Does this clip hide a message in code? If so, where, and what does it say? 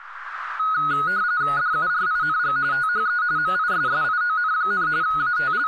Yes: RTTY (45.45 baud, 170 Hz shift) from 0.6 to 5.7 s, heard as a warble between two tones, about 1360 Hz centre, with radio static and speech in Dogri. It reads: DURING THE MISSION, …